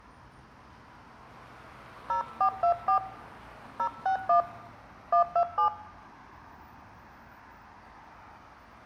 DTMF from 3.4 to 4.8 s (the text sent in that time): 061